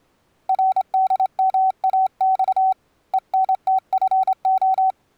Morse code, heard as a keyed tone, hand-sent with a straight key, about 26 wpm, 760 Hz. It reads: RDMAX ENTFO